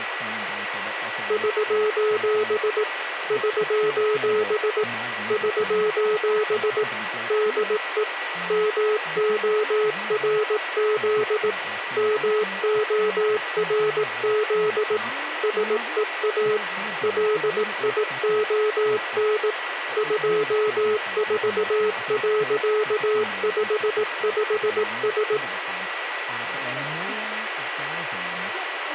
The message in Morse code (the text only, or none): <SOS> <SOS> <SOS> DE MORZ MORZ SEA LION 24.55S